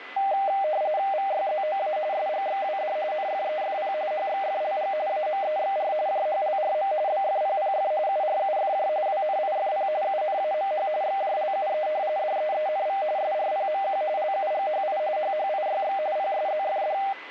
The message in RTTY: VYZOA SGXWD NFEFP HXFLG AMEXR JHLRM BFPPF URUFJ WNIFP UNAMH XJLUE DEENV SRPMQ LUGHI HHIYX PSZFD

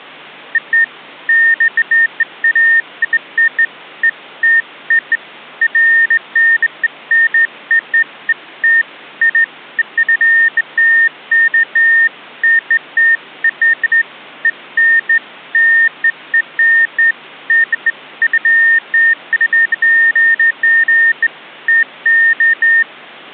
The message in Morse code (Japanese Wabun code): none

